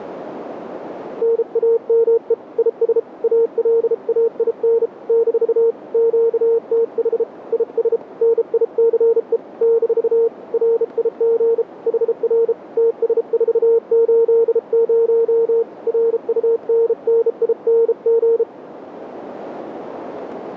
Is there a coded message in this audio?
Yes: Morse code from 1.2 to 18.5 s, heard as a keyed tone, hand-sent with a bug key, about 33 wpm, 460 Hz, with radio static. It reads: NAME IS ALAIN - QTH IS NICE - RIG HR TS480 RUNNING